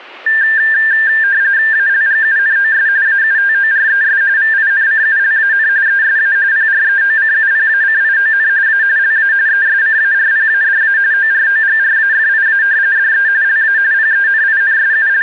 RTTY (45.45 baud, 170 Hz shift), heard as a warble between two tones, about 1700 Hz centre. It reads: ALGUNOS AUTORES VINCULAN ESA PREOCUPACION A LA ESCARPADA OROGRAFIA DE LA …